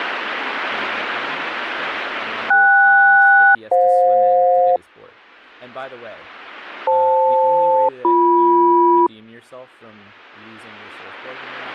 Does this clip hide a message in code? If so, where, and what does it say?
Yes: aircraft SELCAL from 2.5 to 9.1 s, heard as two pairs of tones, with speech in English. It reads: KS-FJ FL-BM